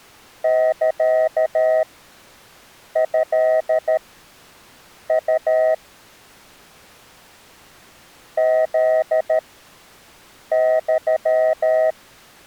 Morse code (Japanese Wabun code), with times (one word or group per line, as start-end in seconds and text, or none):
0.4-5.7 サトウ
8.4-11.9 フユ